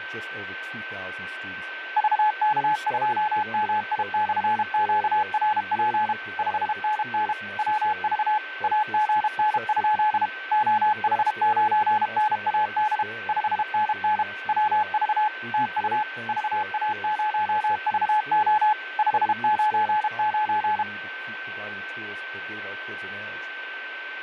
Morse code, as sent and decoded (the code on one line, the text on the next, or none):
...- -.- ..--- -- .. -..-. --.- .-. .--. / ..... -. -. / .-- ...- / .- --. -. ..--.. / --- .... ----. -. .- -.. / ..... -. -. / .-- ...- / - ..- / ...- .- ----- ...- --- / ..... ----. ----.
VK2MI/QRP 5NN WV AGN? OH9NAD 5NN WV TU VA0VO 599